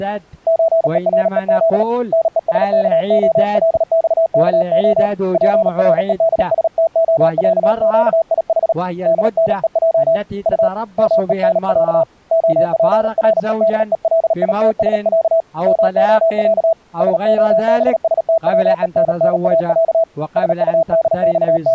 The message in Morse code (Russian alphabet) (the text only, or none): ЧЕРЕЗ НЕСКОЛЬКО ПРЕДСТОЯЩИХ ДНЕЙ У МЕНЯ ОПРЕДЕЛИТСЯ МОЯ СОБСТВЕННАЯ …